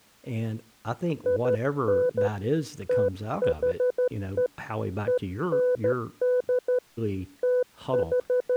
Morse code (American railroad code), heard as a keyed tone, hand-sent with a straight key, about 500 Hz, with speech in English. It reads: IN THE END …